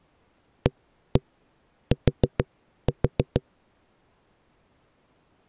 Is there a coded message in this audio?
Yes: tap code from 0.7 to 3.4 s, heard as knocks on a wall, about 6 knocks a second. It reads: AT